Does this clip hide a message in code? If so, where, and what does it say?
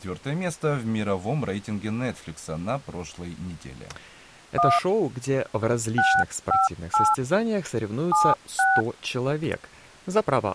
Yes: DTMF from 4.6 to 8.8 s, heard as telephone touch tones, dialled by hand, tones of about 210 ms, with speech in Russian. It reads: 1 658 76